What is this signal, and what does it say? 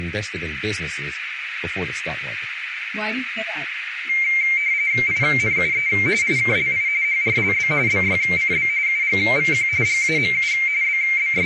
RTTY (45.45 baud, 170 Hz shift), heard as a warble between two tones, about 2200 Hz centre, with radio static, a narrow filter, room echo and speech in English. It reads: INUE IKLI HRLB BYCB UGVQ GAMU …